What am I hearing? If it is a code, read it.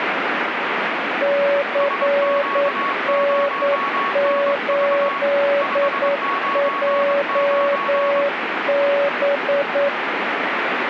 Morse code, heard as two keyed tones, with radio static. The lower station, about 9 wpm, 570 Hz: CN8JB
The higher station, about 23 wpm, 1110 Hz: SQ0NV 599